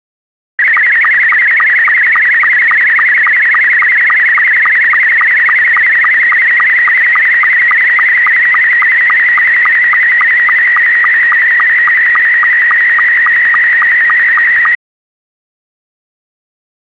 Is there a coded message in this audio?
Yes: SSTV (slow-scan television), Scottie S2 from 0.6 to 14.8 s, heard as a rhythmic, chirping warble.